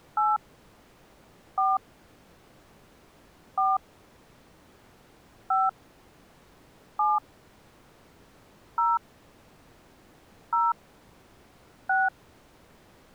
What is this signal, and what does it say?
DTMF, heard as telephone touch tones, dialled by hand, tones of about 200 ms. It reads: 8 4 4 5 7 0 0 6